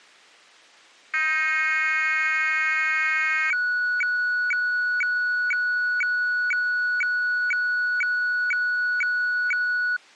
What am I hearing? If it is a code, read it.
Weather fax (radiofax), 120 lines a minute, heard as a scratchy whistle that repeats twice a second.